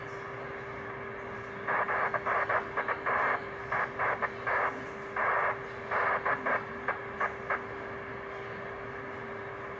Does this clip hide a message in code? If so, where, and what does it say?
No, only bursts of noise, with radio static, a steady whistle near 400 Hz and the noise of a crowd indoors.